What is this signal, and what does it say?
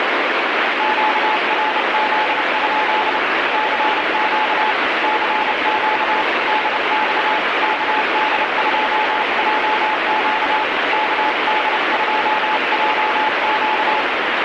Morse code, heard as a keyed tone, hand-sent with a paddle, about 30 wpm, 860 Hz, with heavy radio static. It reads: QRZ? CQ CQ DX KD2JQ KD2JQ